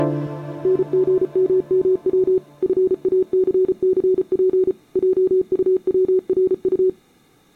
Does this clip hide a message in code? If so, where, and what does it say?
Yes: Morse code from 0.6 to 7.0 s, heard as a keyed tone, machine-sent, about 34 wpm, 370 Hz. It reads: NGMMW FACCP JUWRU